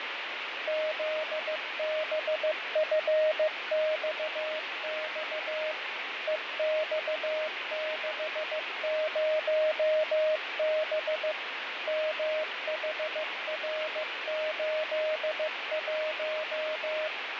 Morse code, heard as a keyed tone, machine-sent, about 15 wpm, 620 Hz, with radio static and fading. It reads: ZBFXX EX60B MHR81